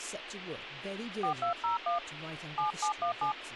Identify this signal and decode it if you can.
DTMF, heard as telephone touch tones, dialled by hand, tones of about 130 ms, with radio hiss and speech in English. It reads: 4201 7717